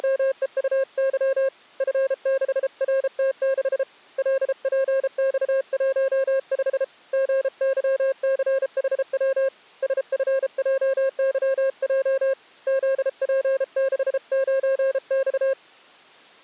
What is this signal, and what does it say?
Morse code, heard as a keyed tone, hand-sent with a paddle, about 33 wpm, 540 Hz. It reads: … F6RT6 LPX15 GYCHW SFJYJ ZP69X